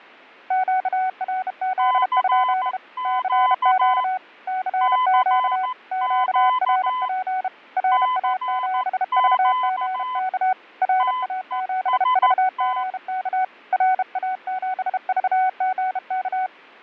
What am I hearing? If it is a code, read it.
Morse code, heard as two keyed tones, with fading. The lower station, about 32 wpm, 750 Hz: QRZ? CQ CQ QRP RA7VGK RA7VGK RA7VGK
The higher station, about 14 wpm, 1010 Hz: CQ CQ CQ TEST